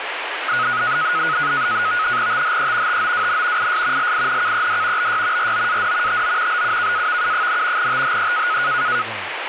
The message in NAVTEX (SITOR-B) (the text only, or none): THE TOWN IS LINKED BY ROAD TO BUKAVU, THE